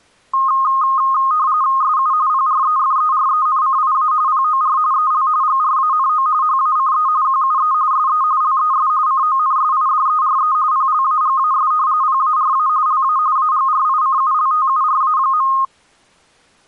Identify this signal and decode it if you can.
RTTY (45.45 baud, 170 Hz shift), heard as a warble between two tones, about 1160 Hz centre. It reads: SU PREFERENCIA POR EL GRANO HACE QUE SE LES CONSIDERE PLAGAS PARA LA AGRICULTURA.